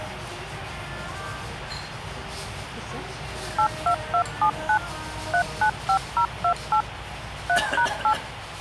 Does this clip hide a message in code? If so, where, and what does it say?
Yes: DTMF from 3.6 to 8.1 s, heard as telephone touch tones, dialled by machine, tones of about 80 ms, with phone line noise and the noise of a restaurant. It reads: 82279 395028 3#8